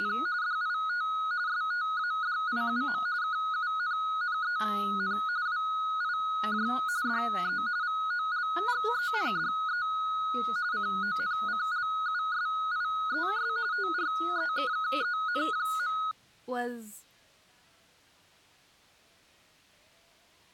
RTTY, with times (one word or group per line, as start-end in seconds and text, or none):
0.0-0.1 …
0.4-1.1 DIT
1.5-3.0 STADIUM
3.2-5.2 KUNNEN
5.5-6.7 WIJ
7.1-7.6 DE
7.8-9.9 VOLGENDE
10.7-13.5 CONCLUSIES
13.7-16.0 TREKKEN.